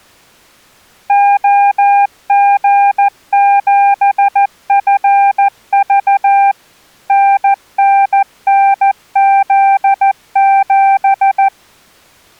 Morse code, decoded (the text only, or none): OG7FV NNNZ7